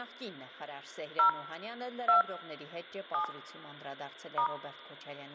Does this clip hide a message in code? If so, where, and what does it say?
Yes: DTMF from 1.2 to 4.5 s, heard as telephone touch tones, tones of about 110 ms. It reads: 0 2 7 *